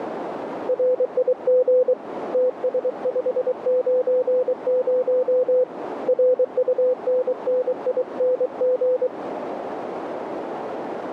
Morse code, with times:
0.7-1.9 RIG
2.3-5.6 TS590
6.1-9.1 RUNNING

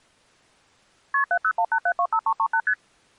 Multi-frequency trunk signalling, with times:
1.1-1.2 KP
1.3-2.6 7018725338
2.7-2.7 ST

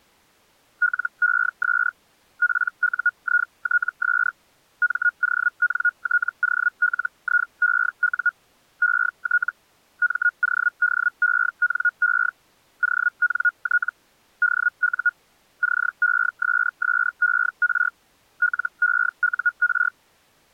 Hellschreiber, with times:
0.8-1.9 LES
2.4-4.3 PUITS
4.8-8.3 MONTOLIEU
8.8-9.5 ET
10.0-12.3 MODENE
12.8-13.9 ONT
14.4-15.1 DU
15.6-17.9 CESSER
18.4-19.9 LEUR

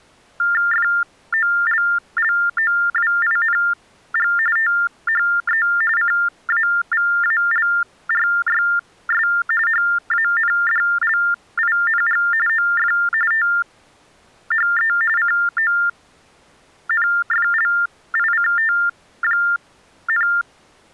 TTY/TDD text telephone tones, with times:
0.7-4.3 FOLLOWING
4.6-5.7 THE
6.0-9.3 CAVALRYS
9.7-12.2 HANDLING
12.5-12.9 OF
13.3-14.9 THE
15.2-20.3 CONFLICT,

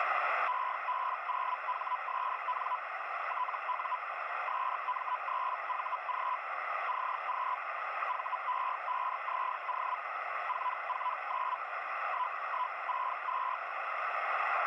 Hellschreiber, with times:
0.5-2.8 EB0HSN
3.3-4.0 TU
4.5-6.4 SM3VG
6.9-7.6 CQ
8.1-10.0 VE5ZO
10.5-11.6 449
12.1-13.6 1162

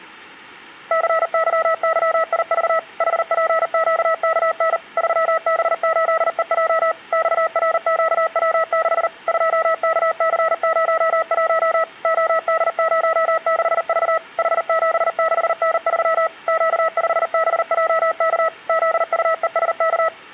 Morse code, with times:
0.9-2.8 CYYIV
3.0-4.8 HPQKN
5.0-6.9 3B8EJ
7.1-9.1 XRQW6
9.3-11.8 2KC01
12.0-14.2 OD06V
14.4-16.3 H76N3
16.5-18.5 Q5BJK
18.7-20.1 ZUESK

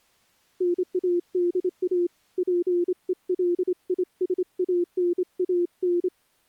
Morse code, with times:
0.6-2.1 NADA
2.4-6.1 PELISANAN

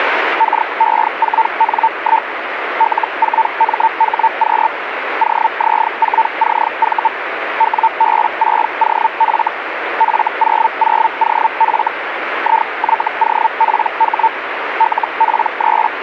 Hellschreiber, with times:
0.4-2.3 KE4N1
2.8-4.7 L4MHQ
5.2-7.1 OZ4CV
7.6-9.5 WB6OF
10.0-11.9 F00OF
12.4-14.3 IYOPH
14.8-16.0 …

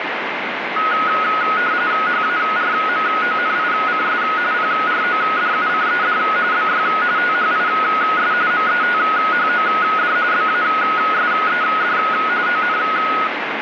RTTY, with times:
2.1-4.2 HARMONICS
4.5-6.2 PRODUCED
6.5-6.9 BY
7.2-8.3 THIS
8.5-10.2 METHOD
10.3-12.0 BASED
12.5-12.8 ON

